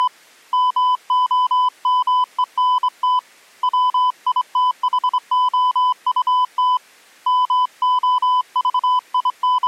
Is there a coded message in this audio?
Yes: Morse code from 0.0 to 9.7 s, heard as a keyed tone, hand-sent with a straight key, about 24 wpm, 1000 Hz. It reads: … MOMENT WITHOUT …